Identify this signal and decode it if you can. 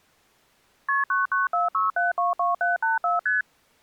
Multi-frequency trunk signalling (R1, as on North American trunks), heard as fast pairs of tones, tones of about 160 ms. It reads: KP 9946722784 ST